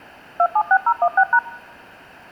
DTMF, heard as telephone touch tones, dialled by machine, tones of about 60 ms. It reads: 276016#